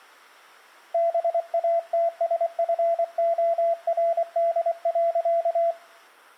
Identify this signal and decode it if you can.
Morse code, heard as a keyed tone, hand-sent with a paddle, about 24 wpm, 680 Hz. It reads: BATSFORD.